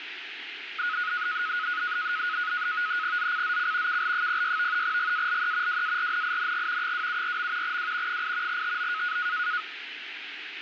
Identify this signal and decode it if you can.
NAVTEX (SITOR-B), 100 baud, 170 Hz shift, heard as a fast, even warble, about 1360 Hz centre, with radio static. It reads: ZCZC KL06 GALE WARNING 274. W 8 TO